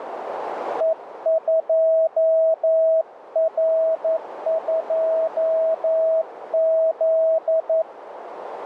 Morse code, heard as a keyed tone, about 11 wpm, 650 Hz, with radio static and a narrow filter. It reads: E2R2Z